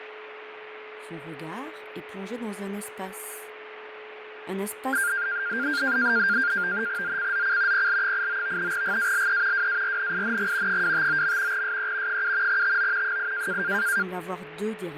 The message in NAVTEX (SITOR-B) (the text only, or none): ZCZC PL89 GALE WARNING 259. SE 7 TO 8